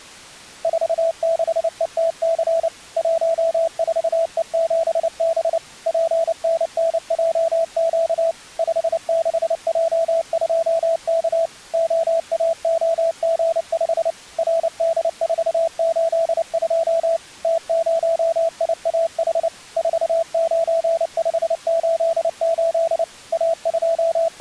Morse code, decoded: 46ETC 14E7B PNNJQ 56J2K OAOG5 RD482 T0IAH 49588 …

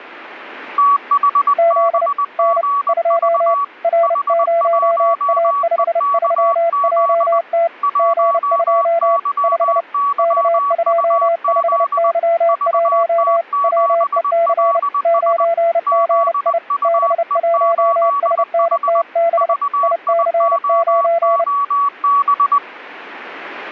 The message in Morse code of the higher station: THBGV H1EKZ 1YYUZ VT7LS ZUE8H VIOOB

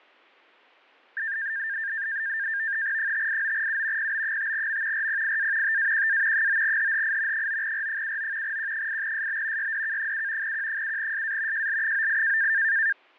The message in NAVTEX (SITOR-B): 589U PB5M RPIA TAQA 9HHI 9R79 Q8SB YDK7 Q7SA JL98

